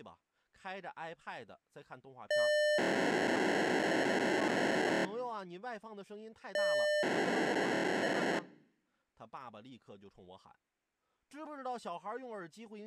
POCSAG pager data (1200 baud), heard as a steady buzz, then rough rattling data, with speech in Chinese.